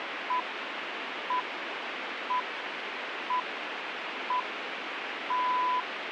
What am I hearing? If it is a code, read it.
Radio time signal (six pips, as the Greenwich Time Signal), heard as pips, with radio hiss.